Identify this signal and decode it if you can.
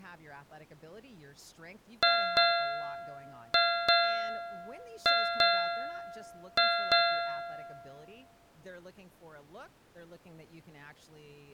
Ship's bell, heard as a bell, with speech in English. 8. Eight half-hours of the watch have passed.